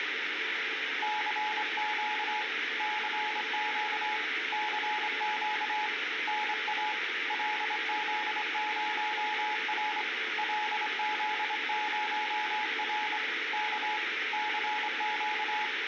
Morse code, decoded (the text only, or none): CQ CQ CQ NA LZ0R LZ0R K CQ